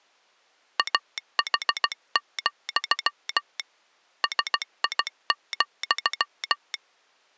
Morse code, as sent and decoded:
.- .... --..-- / ... .. --..--
AH, SI,

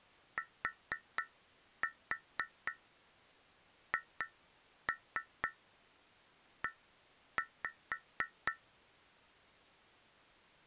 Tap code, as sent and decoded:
4-4 2-3 1-5
THE

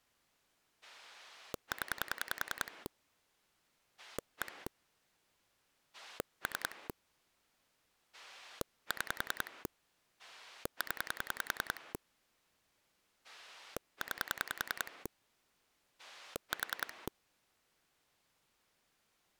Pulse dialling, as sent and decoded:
10 / 1 / 3 / 6 / 10 / 9 / 4
0 1 3 6 0 9 4

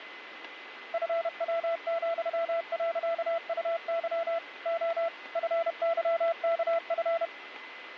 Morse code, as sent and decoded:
..-. .-- --..-- .-.-.- ..- -.-- / --- / ..-. -.-- -.- ..-.
FW,.UY O FYKF

